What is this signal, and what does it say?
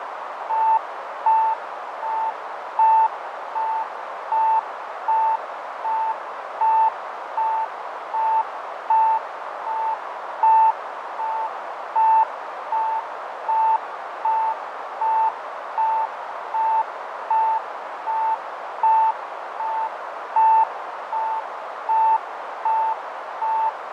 Evenly repeated beeps, with heavy radio static, fading and a narrow filter. There is no code.